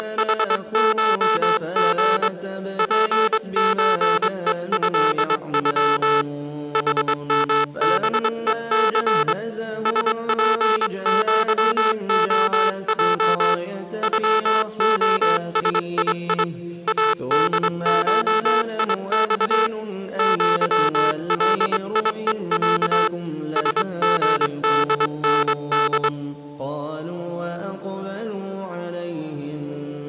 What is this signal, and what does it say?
Morse code (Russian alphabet), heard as a buzzer, hand-sent with a straight key, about 23 wpm. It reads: … ПЧЕЭЮ ХМБЕЦ СПЪОЙ ЮОСИИ АДШИЬ ЪЛИЕЯ СГДНД